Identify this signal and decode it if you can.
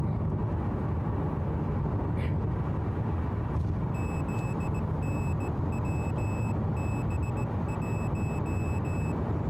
Morse code, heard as a high beeper, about 17 wpm, 2600 Hz, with the noise inside a car. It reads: ZNWB1